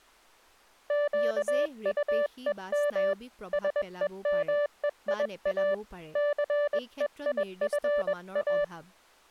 Morse code, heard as a keyed tone, hand-sent with a paddle, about 21 wpm, 580 Hz, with speech in Assamese. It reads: QUEM SEMEIA CEIFA